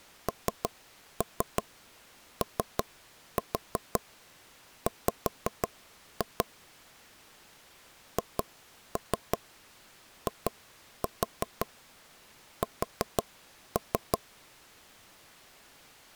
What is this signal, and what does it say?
Tap code, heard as knocks on wood, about 5 knocks a second. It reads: NOW HIS